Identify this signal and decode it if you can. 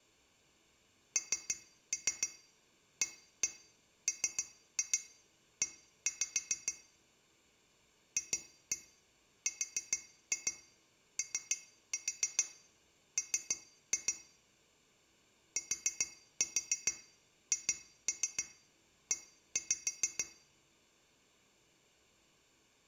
Tap code, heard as taps on glass, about 6 knocks a second, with room echo. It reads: NAME FROM THE